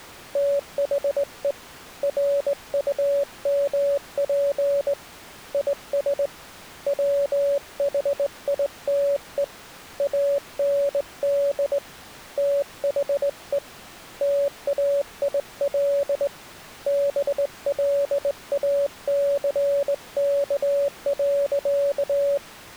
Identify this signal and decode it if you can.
Morse code, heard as a keyed tone, hand-sent with a straight key, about 19 wpm, 560 Hz. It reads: THE RUMP IS WHITE AND THE TAIL BLACK.